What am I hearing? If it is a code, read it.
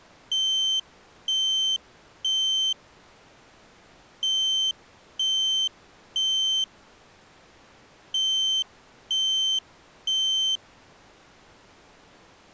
Alarm pattern, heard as an alarm's beeps, played three times, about 3100 Hz. Temporal three. Smoke or fire, evacuate.